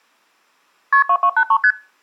Multi-frequency trunk signalling (R1, as on North American trunks), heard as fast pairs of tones, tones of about 70 ms. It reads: KP 2283 ST